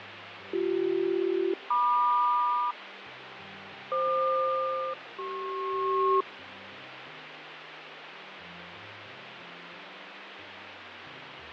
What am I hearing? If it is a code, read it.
Aircraft SELCAL, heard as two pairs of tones, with radio static and fading. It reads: BC-MQ FQ-CP